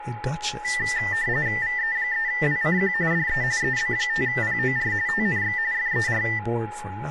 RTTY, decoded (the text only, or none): VE3WCQ DE EB5POR TNX FER